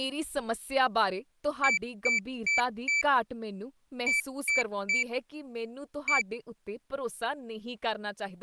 Beep code, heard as a piezo beeper, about 2300 Hz, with speech in Punjabi. 4-3-1. In Phoenix BIOS tables: memory failure above the first 64 KB.